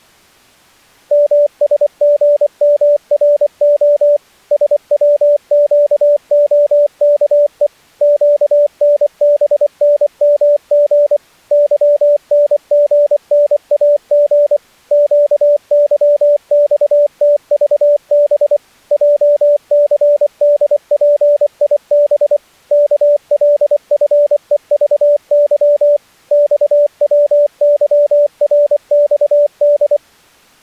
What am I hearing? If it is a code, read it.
Morse code, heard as a keyed tone, machine-sent, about 24 wpm, 580 Hz. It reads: MSGMRO SWQOKE QNBNMG YNGNAG QYXTVB JCDPIB KLFEVY XWYRXD